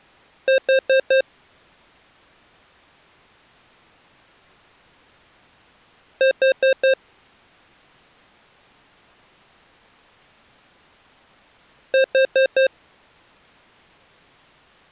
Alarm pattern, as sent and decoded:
4 beeps and a pause
temporal four

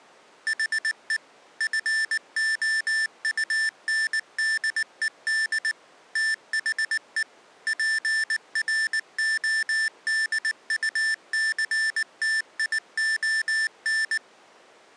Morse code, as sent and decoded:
.... . / ..-. --- ..- -. -.. . -.. / - .... . / .--. .-. --- -.. ..- -.-. - .. --- -.
HE FOUNDED THE PRODUCTION

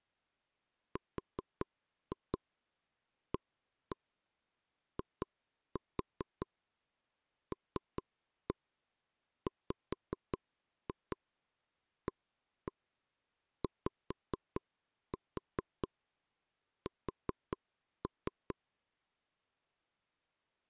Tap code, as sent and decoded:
4-2 1-1 2-4 3-1 5-2 1-1 5-4 4-3
RAILWAYS

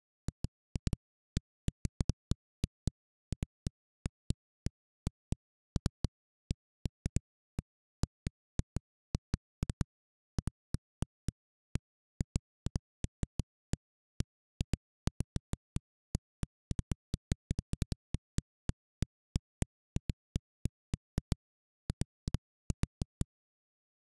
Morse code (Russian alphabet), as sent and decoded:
none

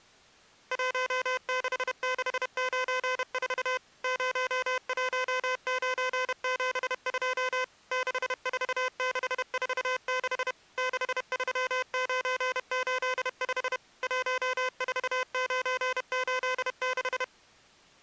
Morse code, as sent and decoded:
.---- -.... -.... ----. ....- / ----- .---- ----. --... ..--- / -.... ....- -.... ....- -.... / -.... ...-- ----. ---.. ..... / .---- ....- ----. ---.. -....
16694 01972 64646 63985 14986

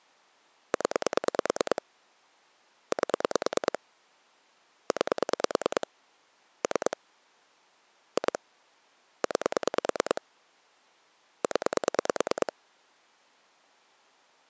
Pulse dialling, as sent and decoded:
10 / 8 / 9 / 3 / 2 / 9 / 10
0 8 9 3 2 9 0

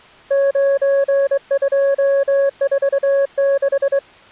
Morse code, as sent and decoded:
----. ..--- ....- -....
9246

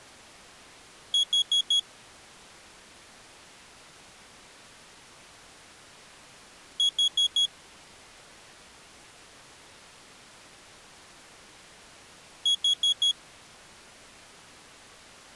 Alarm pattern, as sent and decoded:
4 beeps and a pause
temporal four

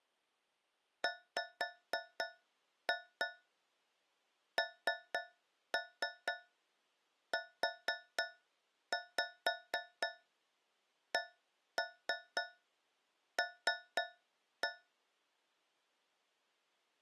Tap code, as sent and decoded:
5-2 3-3 4-5 1-3 3-1
WNUCL

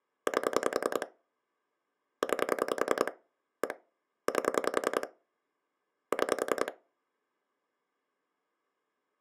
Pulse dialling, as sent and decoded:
8 / 9 / 1 / 8 / 6
8 9 1 8 6

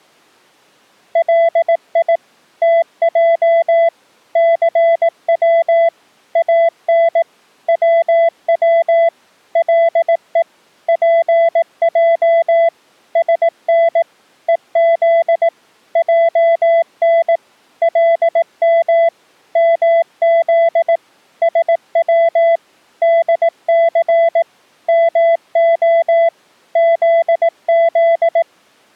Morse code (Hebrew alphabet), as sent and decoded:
.-.. .. / - .--- / -.-. .-- / .- -. / .-- .-- / .-.. . / .--. .--- / ... -. / . --.. / .--- -. / .-.. -- / -- --.. / ... .-- / -.. -.-. / -- --- / --.. --..
לי תע סץ אן צץ לו פע שן וז ען לם מז שץ דס מה זז

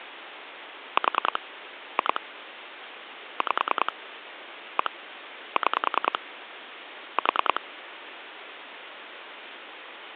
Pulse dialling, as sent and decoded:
4 / 2 / 5 / 1 / 6 / 4
4 2 5 1 6 4

